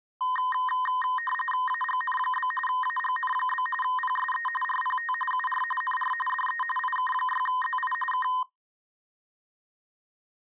RTTY (45.45 baud, 850 Hz shift), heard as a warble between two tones, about 1440 Hz centre. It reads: AGN? AGN? PSE RPT UR NR DE IK6ZI K